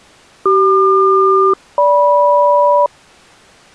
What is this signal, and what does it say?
Aircraft SELCAL, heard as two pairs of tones. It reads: CQ-GM